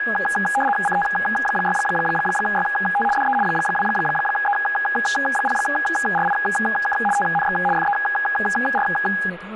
RTTY (75 baud, 850 Hz shift), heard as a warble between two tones, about 1240 Hz centre, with speech in English. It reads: CT6YT DE 2E0RIK TNX FER